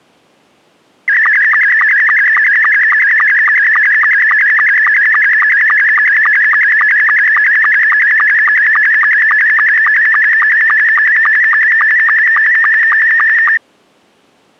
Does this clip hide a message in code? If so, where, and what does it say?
Yes: SSTV (slow-scan television), Scottie S2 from 1.1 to 13.6 s, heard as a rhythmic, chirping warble.